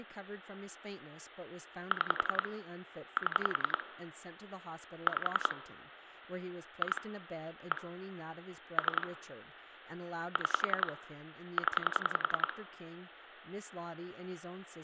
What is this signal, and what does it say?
Pulse dialling, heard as clicks on a phone line, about 10 pulses a second, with room echo and speech in English. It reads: 6 7 5 2 1 3 6 0